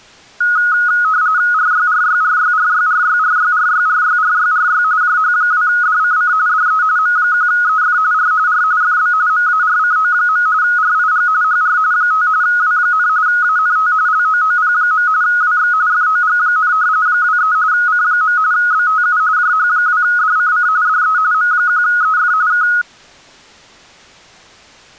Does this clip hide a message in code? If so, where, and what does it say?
Yes: RTTY (45.45 baud, 170 Hz shift) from 0.4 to 22.8 s, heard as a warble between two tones, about 1360 Hz centre. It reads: RYRYRYRYRYRYRYRYRYRY JH2DCC DE M1EF R R FB MARCO. RIG HR 5 W, ANT LOOP. WX FOG, 23 C. BTU JH2DCC DE M1EF K